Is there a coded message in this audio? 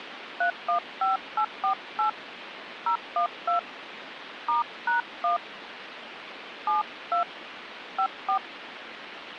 Yes: DTMF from 0.4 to 8.4 s, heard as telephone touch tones, dialled by hand, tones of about 110 ms, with phone line noise. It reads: 315848 012 *#1 72 54